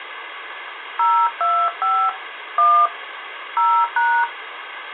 DTMF, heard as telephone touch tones, dialled by hand, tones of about 280 ms, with phone line noise. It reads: 025 1 0#